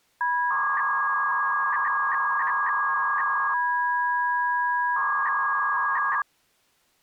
300-baud modem data (V.21 tones), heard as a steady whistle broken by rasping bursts, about 300 baud, 200 Hz shift.